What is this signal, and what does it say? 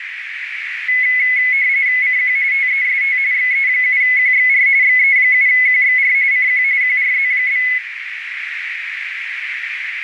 RTTY (45.45 baud, 170 Hz shift), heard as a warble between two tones, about 2100 Hz centre, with radio static and a narrow filter. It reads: CQ TEST XE7QXR XE7QXR CQ QRZ?